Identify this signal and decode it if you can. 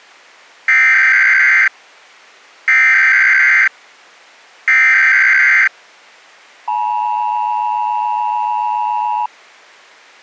Emergency Alert System (SAME) tones (header bursts, then the 853 and 960 Hz attention tone), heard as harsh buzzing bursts, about 520.83 baud.